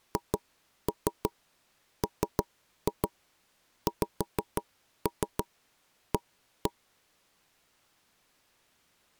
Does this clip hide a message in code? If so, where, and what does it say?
Yes: tap code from 0.2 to 6.7 s, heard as knocks on wood, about 6 knocks a second. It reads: HMXA